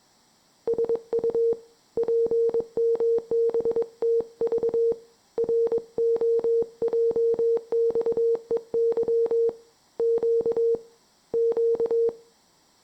Morse code, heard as a keyed tone, hand-sent with a paddle, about 22 wpm, 460 Hz, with room echo. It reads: SU PMBTV ROJXEY Q Q